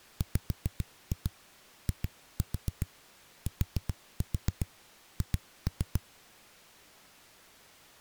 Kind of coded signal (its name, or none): tap code